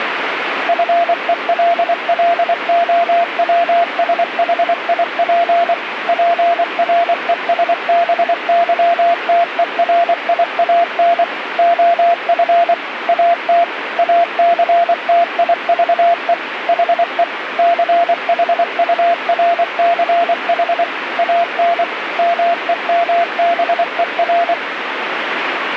Morse code, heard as a keyed tone, machine-sent, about 24 wpm, 690 Hz, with radio static. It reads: FELLOWSHIP PRESBYTERIAN OF AT ACTIVE HE CHURCH AN MEMBER